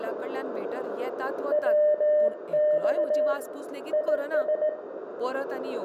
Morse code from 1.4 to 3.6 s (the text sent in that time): WX